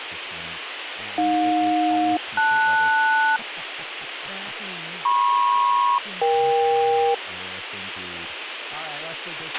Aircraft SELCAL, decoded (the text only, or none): AJ-LS MP-EK